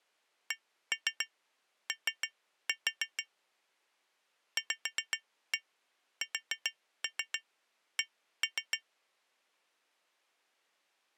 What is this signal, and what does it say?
Tap code, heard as taps on glass, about 7 knocks a second. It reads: CO VSC